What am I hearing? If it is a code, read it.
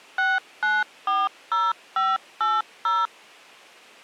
DTMF, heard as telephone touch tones, dialled by machine, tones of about 200 ms. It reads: 6940580